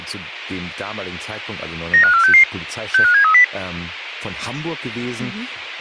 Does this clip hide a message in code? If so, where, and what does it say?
Yes: five-tone selective call (CCIR) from 1.9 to 3.4 s, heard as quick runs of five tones, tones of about 100 ms, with speech in German. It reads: 95466 65730